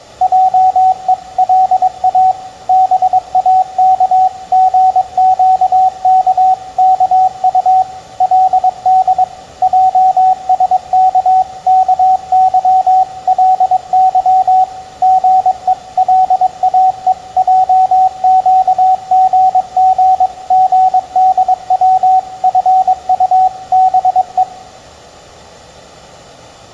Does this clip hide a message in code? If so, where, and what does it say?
Yes: Morse code (Korean alphabet) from 0.2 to 24.5 s, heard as a keyed tone, machine-sent, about 22 wpm, 750 Hz, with room echo. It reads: 하고 동생이 그 형에게 사과했습니다